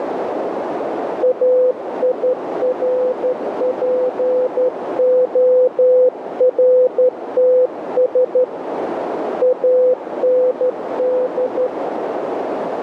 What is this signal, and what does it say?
Morse code, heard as a keyed tone, hand-sent with a straight key, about 12 wpm, 510 Hz, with radio static and a narrow filter. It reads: AIRPORTS AND